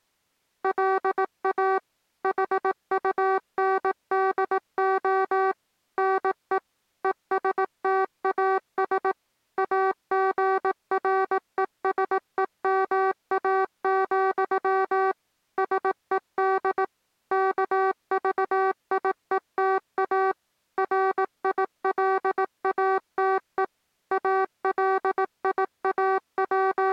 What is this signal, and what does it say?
Morse code, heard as electronic beeps, machine-sent, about 18 wpm, 380 Hz. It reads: LA HUNDO NE ESTAS AGRESEMA, SED KVIETA RILATE …